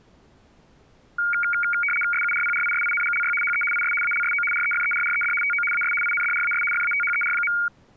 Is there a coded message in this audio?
Yes: RTTY (75 baud, 850 Hz shift) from 1.2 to 7.7 s, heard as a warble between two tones, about 1850 Hz centre. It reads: SURPRISINGLY HE IS ALSO REFERRED TO AS INDRAS FATHER.